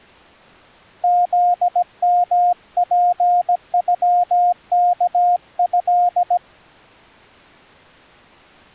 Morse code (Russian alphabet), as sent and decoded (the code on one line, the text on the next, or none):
--.. -- .--. ..-- -.- ..-..
ЗМПЮКЭ